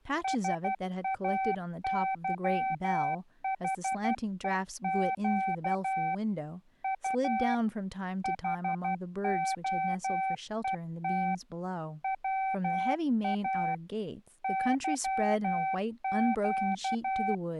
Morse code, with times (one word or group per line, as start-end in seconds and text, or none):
0.2-6.1 SAYHEQ
6.8-7.5 U
8.2-11.3 HOET
12.0-13.7 WA
14.4-17.3 YQ